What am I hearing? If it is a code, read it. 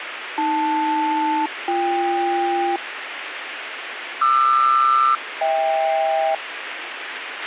Aircraft SELCAL, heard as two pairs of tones, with radio hiss and a squelch burst at the end. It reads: AL-BK QR-HK